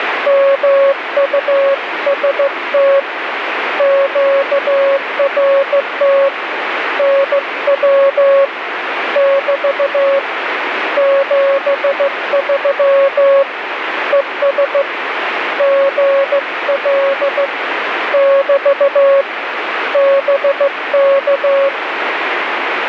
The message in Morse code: MUST QRT NW <BT> 73 ES GL <BT> BK

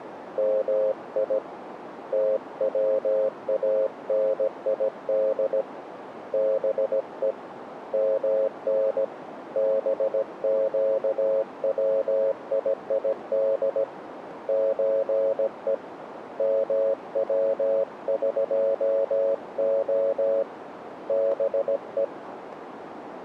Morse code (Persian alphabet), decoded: می توانید به من بگویید چه موقع به

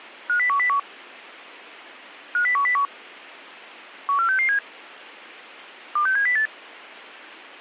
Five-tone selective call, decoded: 50101 50101 14667 26708

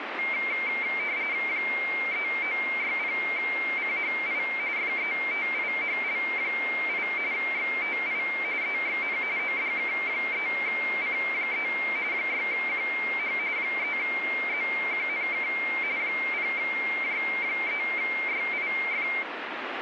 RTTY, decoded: 3960CHI FETIHL8 XTI EXN ODK3C3 6QH 3ZQNK 0J3YIF

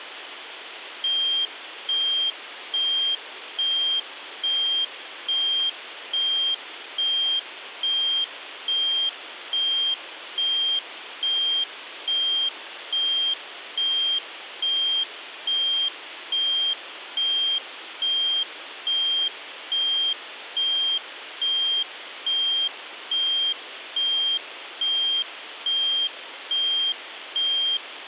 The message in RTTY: none

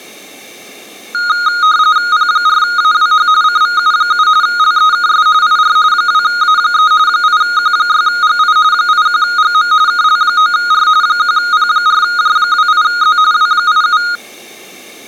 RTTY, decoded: P4AWH CVU7 LEKS IR 2A3 8Q6GI 81GM KL9R 1P4J28Z W87

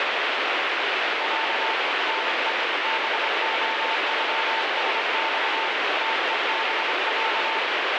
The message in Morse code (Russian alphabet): Я НЕ БОЮСЬ ТЕБЯ

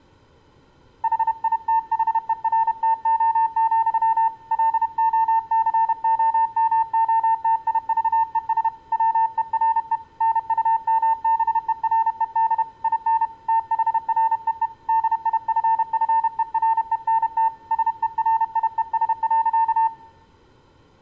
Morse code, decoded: HITHERTO, LOCOMOTIVES WERE NUMBERED IN THREE DIFFERENT SERIES.

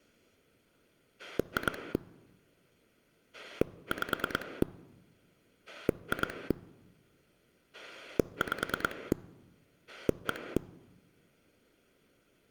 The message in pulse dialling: 2 5 2 5 1

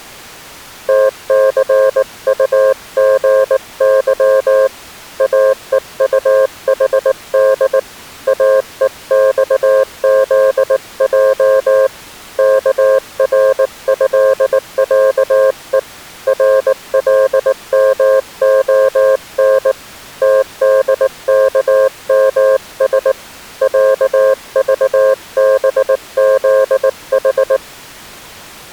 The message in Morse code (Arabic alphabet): تثطغظ اءطحد اءصذج كرهعء رلمخن تدكمس عضبذح

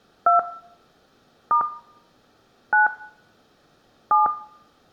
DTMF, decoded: 2 * 9 7

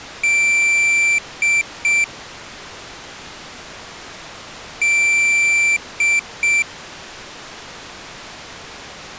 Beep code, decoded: 1 long, 2 short

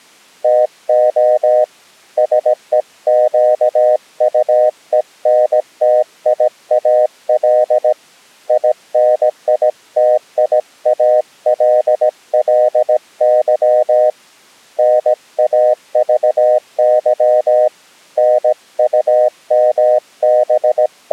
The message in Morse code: TO SEQUENTIAL INITIALLY NAVY …

